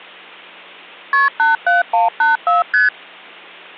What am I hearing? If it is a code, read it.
Multi-frequency trunk signalling (R1, as on North American trunks), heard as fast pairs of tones, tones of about 150 ms. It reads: KP 87184 ST